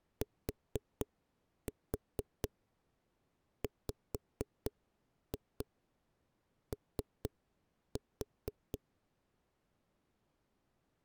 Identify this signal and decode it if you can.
Tap code, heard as knocks on a wall, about 4 knocks a second. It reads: TWO